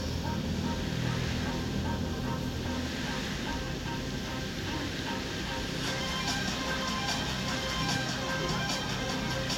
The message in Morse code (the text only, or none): none